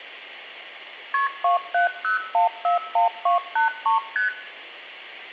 Multi-frequency trunk signalling (R1, as on North American trunks), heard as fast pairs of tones, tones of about 130 ms, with room echo. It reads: KP 270141283 ST